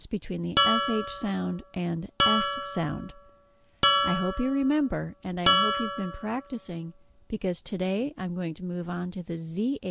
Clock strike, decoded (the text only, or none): 4